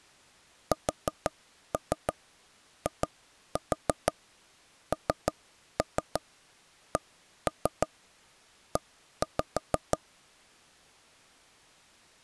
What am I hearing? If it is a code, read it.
Tap code, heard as knocks on wood, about 6 knocks a second. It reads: SINCE